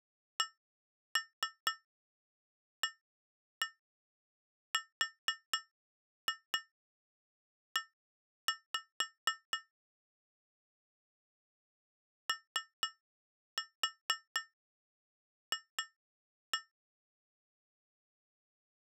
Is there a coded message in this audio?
Yes: tap code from 0.4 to 16.7 s, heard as taps on glass, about 4 knocks a second. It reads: CARE OF